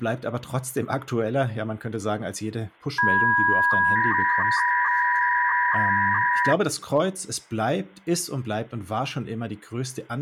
300-baud modem data (V.21 tones), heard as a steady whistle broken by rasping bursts, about 300 baud, 200 Hz shift, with hum and speech in German.